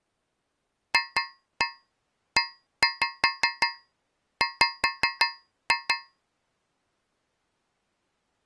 Tap code, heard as taps on a metal pipe, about 5 knocks a second. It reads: FEW